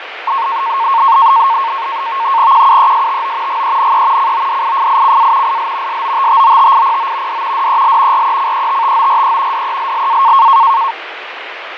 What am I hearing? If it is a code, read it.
NAVTEX (SITOR-B), 100 baud, 170 Hz shift, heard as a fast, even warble, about 1000 Hz centre, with radio static and fading. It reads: QUESTO GENE CODIFICA IL SOTTOTIPO D DEL RECETTORE DELLA